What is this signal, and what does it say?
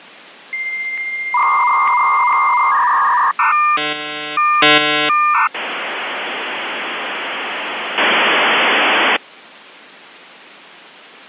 Dial-up modem handshake (V.34 or later), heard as a whistle, warbles, then hiss.